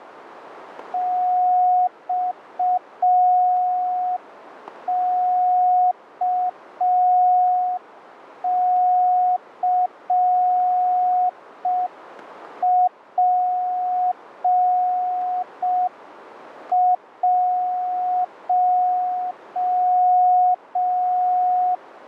Morse code, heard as a keyed tone, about 5 wpm, 730 Hz, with radio static. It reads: XKCP1